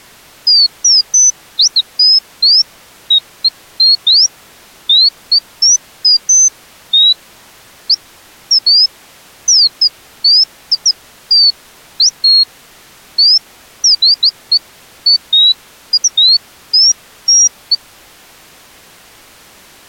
Bird-like chirps. There is no code.